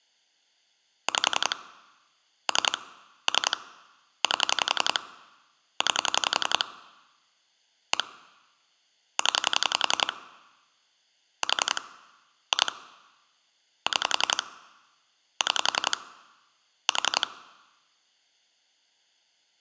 Pulse dialling, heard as clicks on a phone line, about 11 pulses a second. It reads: 5 3 3 8 9 1 0 4 2 6 6 4